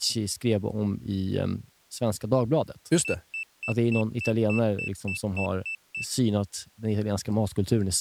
Beep code, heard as a piezo beeper, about 2650 Hz, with speech in Swedish. 11 short. In AMI BIOS tables: cache memory error.